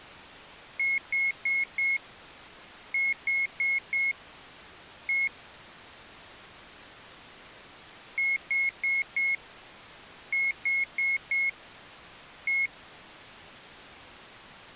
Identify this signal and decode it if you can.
Beep code, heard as beeps from a small speaker, played twice, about 2150 Hz. 4-4-1. In Phoenix BIOS tables: serial port failure.